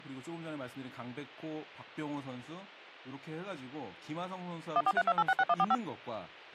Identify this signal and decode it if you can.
DTMF, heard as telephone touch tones, dialled by machine, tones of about 50 ms, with speech in Korean. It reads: 1432866145